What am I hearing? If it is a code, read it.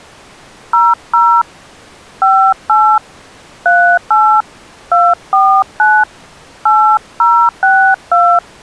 DTMF, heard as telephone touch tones, dialled by hand, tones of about 280 ms. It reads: 00 58 38 249 8062